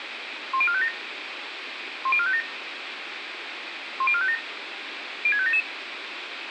Five-tone selective call (ZVEI), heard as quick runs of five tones, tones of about 70 ms, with radio hiss, a squelch burst at the end and room echo. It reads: 10457 10457 10457 06577